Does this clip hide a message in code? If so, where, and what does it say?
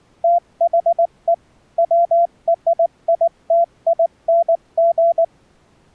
Yes: Morse code (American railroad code) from 0.2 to 5.3 s, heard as a keyed tone, machine-sent, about 690 Hz. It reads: THE WRITING